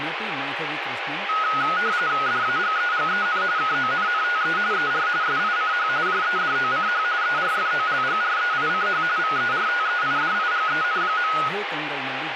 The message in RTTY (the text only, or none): DAGEGEN KONNTE ER SICH JEDOCH ERFOLGREICH VERTEIDIGEN.